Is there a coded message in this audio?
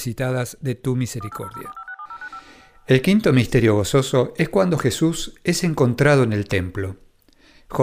Yes: DTMF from 1.2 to 2.4 s, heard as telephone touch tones, dialled by machine, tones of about 70 ms, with room echo and speech in Spanish. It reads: 18004567095